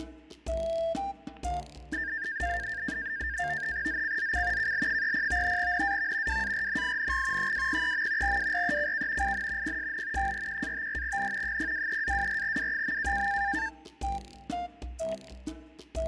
NAVTEX (SITOR-B), 100 baud, 170 Hz shift, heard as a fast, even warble, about 1700 Hz centre, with static crashes. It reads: ZCZC KL30 NAV WARNING 203. WRECK IN PSN 41-54N 023-24W.